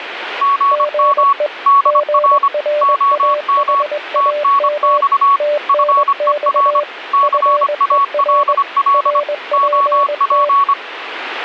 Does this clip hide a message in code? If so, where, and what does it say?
Yes: Morse code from 0.4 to 10.8 s, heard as two keyed tones, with radio static. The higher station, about 25 wpm, 1120 Hz: GM DR OM TNX FER CALL OP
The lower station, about 21 wpm, 590 Hz: GE GRAHAM TNX FER RPT